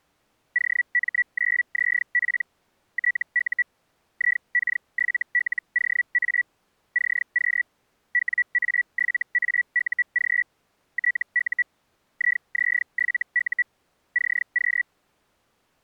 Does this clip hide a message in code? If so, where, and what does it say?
Yes: Hellschreiber (Feld-Hell, 122.5 baud) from 0.5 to 14.8 s, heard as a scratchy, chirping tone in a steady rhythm, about 1950 Hz. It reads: OM9ZP TU IK7LOA CQ WA7AUG TU IZ7U CQ